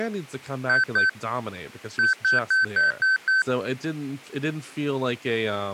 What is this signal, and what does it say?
Beep code, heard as beeps, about 1550 Hz, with speech in English. 2-6.